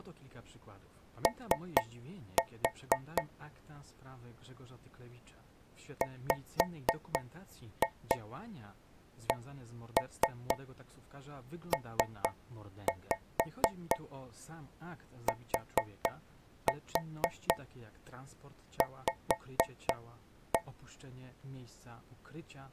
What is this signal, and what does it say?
Tap code, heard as taps on a metal pipe, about 4 knocks a second, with speech in Polish. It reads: O WCPTV